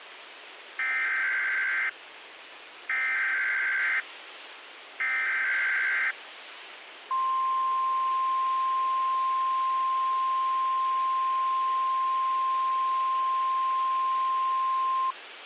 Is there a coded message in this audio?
Yes: Emergency Alert System (SAME) tones (header bursts, then the 1050 Hz attention tone) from 0.8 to 15.1 s, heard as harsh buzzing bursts, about 520.83 baud, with radio hiss.